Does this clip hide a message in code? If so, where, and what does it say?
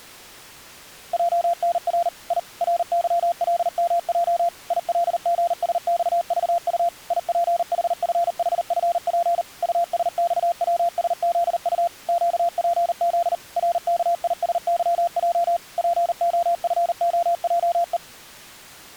Yes: Morse code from 1.1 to 18.0 s, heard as a keyed tone, machine-sent, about 39 wpm, 690 Hz. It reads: JNR I RYLMJ ILGSXVU IPHFHFP USXWSZU QPZ RKISYJ POFOJE